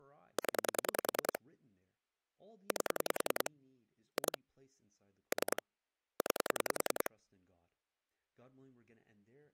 Pulse dialling, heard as clicks on a phone line, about 10 pulses a second, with speech in English. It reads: 0 8 2 3 9